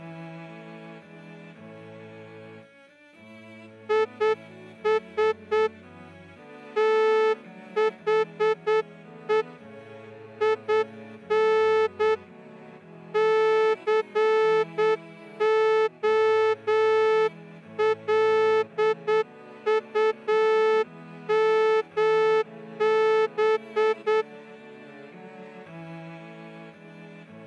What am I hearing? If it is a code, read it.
Morse code, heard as a horn, hand-sent with a straight key, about 8 wpm. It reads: IS THE IN COLUMB